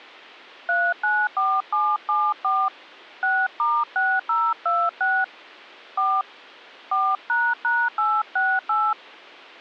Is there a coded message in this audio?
Yes: DTMF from 0.7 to 8.9 s, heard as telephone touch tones, dialled by hand, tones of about 240 ms. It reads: 394774 6*6026 4 4##868